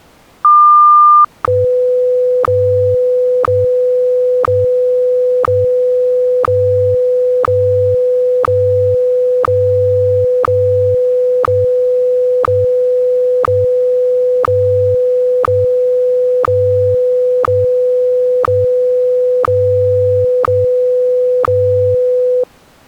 Radio time signal (WWVH, Hawaii), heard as ticks, one a second.